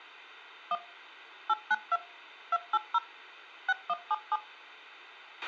DTMF, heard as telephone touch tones, dialled by machine, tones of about 40 ms, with a squelch burst at the end. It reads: 1 892 280 6177